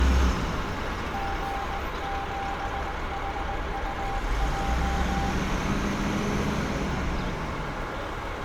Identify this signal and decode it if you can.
Morse code, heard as a keyed tone, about 19 wpm, 790 Hz, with heavy radio static and street noise. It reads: G7HUJ